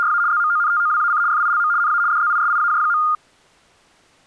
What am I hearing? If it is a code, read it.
RTTY (75 baud, 170 Hz shift), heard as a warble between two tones, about 1320 Hz centre. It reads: … ZMONTOWAC FILM NA DZISIAJ.